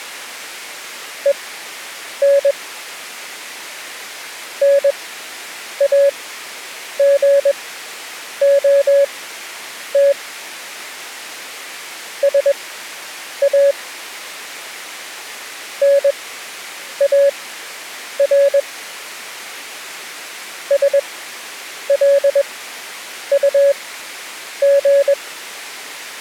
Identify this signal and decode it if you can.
Morse code, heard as a keyed tone, machine-sent, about 21 wpm, spaced as for 8 wpm, 560 Hz. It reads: EN NAGOT SA NAR SLUG